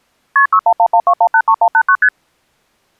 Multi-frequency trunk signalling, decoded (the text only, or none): KP 61112183189 ST